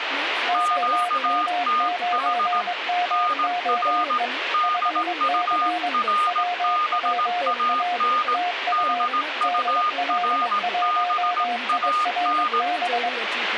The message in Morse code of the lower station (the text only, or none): OM9MOE 5C WPA TU DL1IRB